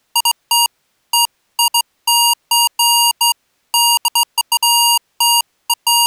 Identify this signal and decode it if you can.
Beeps of irregular length. There is no code.